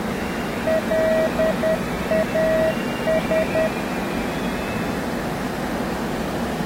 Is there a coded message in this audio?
Yes: Morse code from 0.6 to 3.7 s, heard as a keyed tone, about 10 wpm, 640 Hz, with the noise of a subway station. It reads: LAS